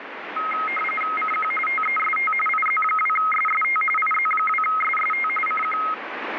RTTY (45.45 baud, 850 Hz shift), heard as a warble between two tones, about 1700 Hz centre, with radio static. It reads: CQ TEST IZ2SST IZ2SST CQ